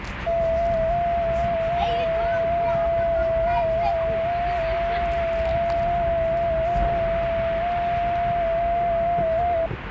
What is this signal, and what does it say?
FT8 (one signal), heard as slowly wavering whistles, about 6.25 baud, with radio static and the noise of a park.